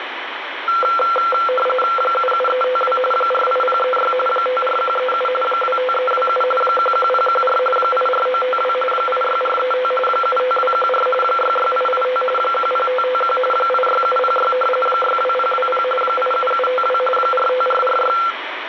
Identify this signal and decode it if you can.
RTTY (45.45 baud, 850 Hz shift), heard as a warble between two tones, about 930 Hz centre, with radio static and room echo. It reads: 77352 48036 54137 25327 11014 84952 86435 75214 66885 10551 86706 62020 87752 45446